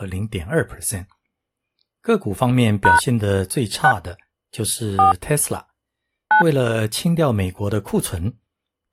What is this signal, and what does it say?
DTMF, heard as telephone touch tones, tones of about 120 ms, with speech in Chinese. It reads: # 6 4 9